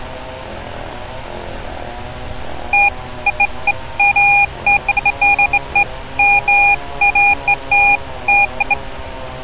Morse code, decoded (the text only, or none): none